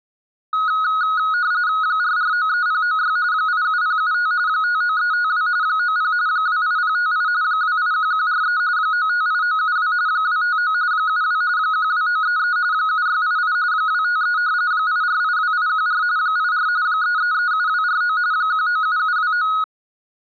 RTTY (45.45 baud, 170 Hz shift), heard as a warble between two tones, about 1360 Hz centre. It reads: 4493096 87075 59352 90 28058 281143 958972 259 72 12933 7688 253 8482814 84 3337249 197729